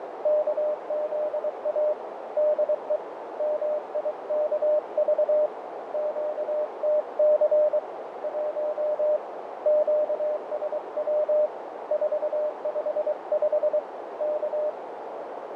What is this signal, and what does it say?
Morse code, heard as a keyed tone, hand-sent with a paddle, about 23 wpm, 600 Hz, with heavy radio static, fading and a narrow filter. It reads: KZA DE MIKV QTC 1 QSW 455 K